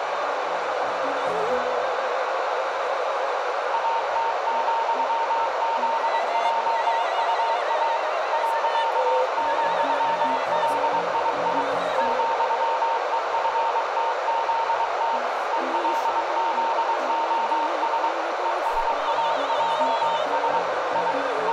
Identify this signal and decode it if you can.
Morse code, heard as a keyed tone, machine-sent, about 23 wpm, 920 Hz, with radio static, a narrow filter and room echo. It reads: AT,ZJUA .,LII ,EFTZT ELZOS ESAJS I …